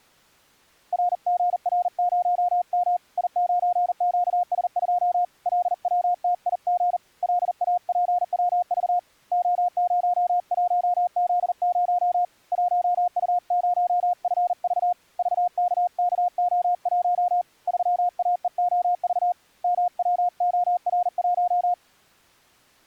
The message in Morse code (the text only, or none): RGR0M I9QS2 LWTIG LAPWV O01Z0 1U0FV VKKO1 3AEOV MWOR1